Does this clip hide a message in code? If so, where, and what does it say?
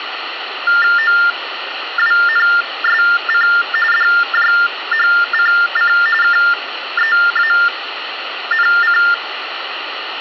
Yes: TTY/TDD text telephone tones (45.45 baud Baudot) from 0.7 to 9.1 s, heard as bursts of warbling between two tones, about 400 Hz shift, 1600 Hz centre, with phone line noise. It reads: OWNSC DJHCC KEANC